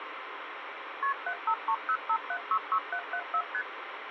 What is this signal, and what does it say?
Multi-frequency trunk signalling (R1, as on North American trunks), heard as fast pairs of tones, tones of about 70 ms, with phone line noise. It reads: KP 75305766774 ST